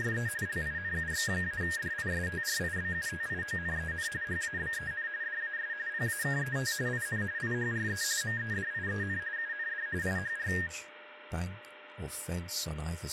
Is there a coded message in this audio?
Yes: RTTY (45.45 baud, 170 Hz shift) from 0.0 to 10.7 s, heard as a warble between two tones, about 1750 Hz centre, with radio static, a steady whistle near 600 Hz and speech in English. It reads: … LINUX-DISTRIBUTIONEN HABEN DAS PAKET IN IHRE MEDIEN UND IHR